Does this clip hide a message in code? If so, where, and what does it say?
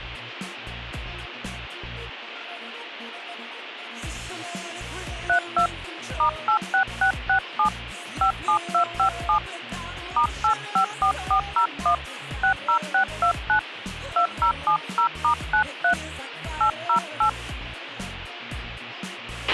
Yes: DTMF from 5.3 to 17.3 s, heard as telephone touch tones, dialled by hand, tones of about 90 ms, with radio hiss and a squelch burst at the end. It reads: 32 *86667 57257 *854401 60629 2070*93 808